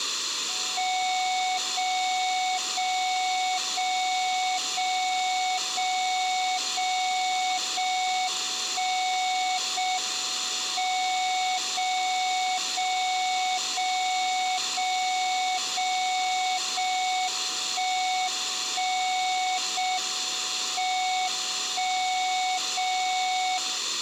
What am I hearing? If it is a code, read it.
Radio time signal (JJY), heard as a tone whose level steps once a second, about 740 Hz, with room echo. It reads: 0 0 0 0 0 0 0 1 0 M 0 0 0 0 0 0 1 1 0 M 1 0 0